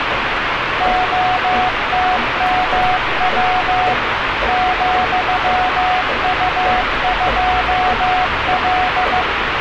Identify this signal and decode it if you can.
Morse code, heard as a keyed tone, machine-sent, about 15 wpm, 740 Hz, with radio static and street noise. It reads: OTMW ,U2L